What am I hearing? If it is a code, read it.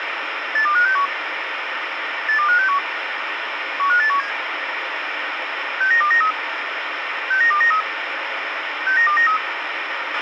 Five-tone selective call (CCIR), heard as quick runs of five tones, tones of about 100 ms, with radio hiss and a squelch burst at the end. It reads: 82561 82561 15817 69293 69293 69293